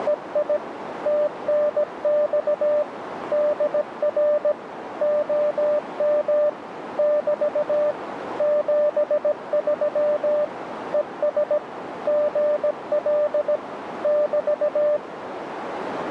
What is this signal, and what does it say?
Morse code, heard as a keyed tone, machine-sent, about 17 wpm, 600 Hz, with radio static and a narrow filter. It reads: … TNX DR OM <BT> 73 ES GL <BT>